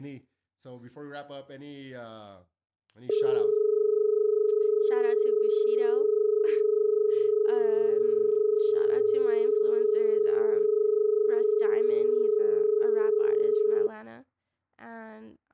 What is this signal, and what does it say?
Telephone call progress tone (as in Australia), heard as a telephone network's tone, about 430 Hz, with speech in English. Dial tone.